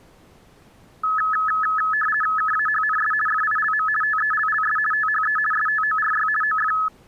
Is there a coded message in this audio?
Yes: RTTY (50 baud, 450 Hz shift) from 1.0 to 6.9 s, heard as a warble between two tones, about 1500 Hz centre. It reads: KAHNS FILM TELLS THE STORY OF